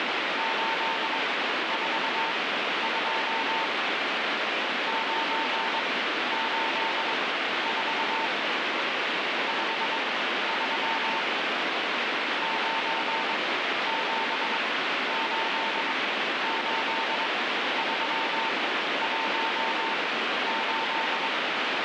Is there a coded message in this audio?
Yes: Morse code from 0.3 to 21.3 s, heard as a keyed tone, machine-sent, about 22 wpm, spaced as for 12 wpm, 900 Hz, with heavy radio static. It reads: 842 984 53 9788318